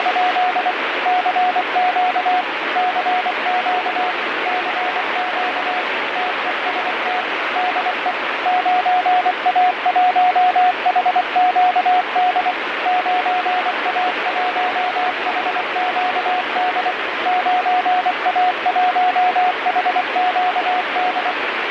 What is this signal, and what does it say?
Morse code, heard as a keyed tone, machine-sent, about 24 wpm, 730 Hz, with heavy radio static. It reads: … CQ CQ CQ TEST DE 9A1HQD 9A1HQD 9A1HQD